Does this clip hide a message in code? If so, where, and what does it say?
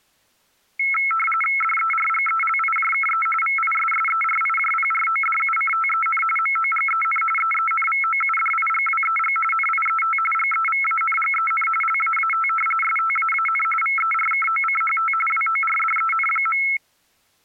Yes: RTTY (45.45 baud, 850 Hz shift) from 0.8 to 16.8 s, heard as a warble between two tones, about 1750 Hz centre. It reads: DERGELIJKE VISSERIJPRODUCTEN MOGEN EENVOUDIGWEG NIET GEVANGEN LAAT STAAN VERKOCHT WORDEN.